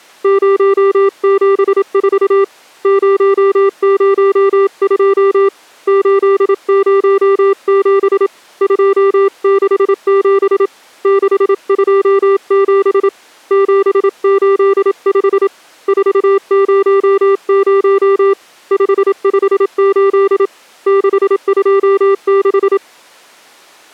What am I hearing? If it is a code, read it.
Morse code, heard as a keyed tone, hand-sent with a paddle, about 27 wpm, 390 Hz. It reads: 074 002 807 267 627 785 400 558 626